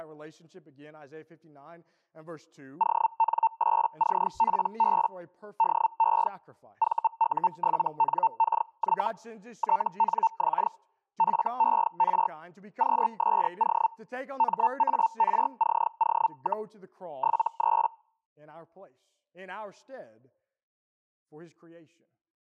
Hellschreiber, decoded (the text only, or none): ON8CPB DE VU7NKY TNX FER QSO MARCO, 73